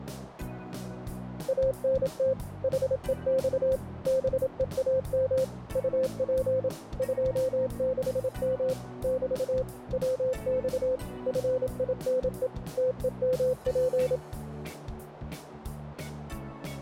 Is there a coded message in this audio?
Yes: Morse code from 1.4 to 14.2 s, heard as a keyed tone, machine-sent, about 27 wpm, 520 Hz, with radio static. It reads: ANT HEX BEAM UP 26M <BT> WX FINE TEMP